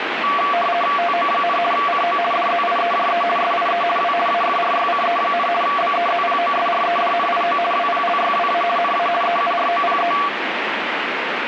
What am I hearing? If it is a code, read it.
RTTY (50 baud, 450 Hz shift), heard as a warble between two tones, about 920 Hz centre, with radio static. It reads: TO, CO DZIEJE SIE W AFRYCE, BEZPOSREDNIO WPLYWA NA EUROPE